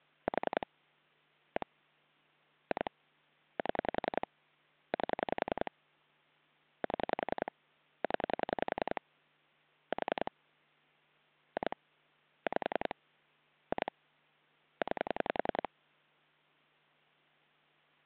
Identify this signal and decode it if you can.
Pulse dialling, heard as clicks on a phone line, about 10 pulses a second. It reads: 4 1 2 7 8 7 0 4 2 5 2 9